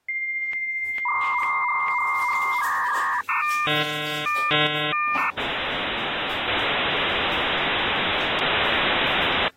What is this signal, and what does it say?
Dial-up modem handshake (V.34 or later), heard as a whistle, warbles, then hiss, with the noise of a restroom.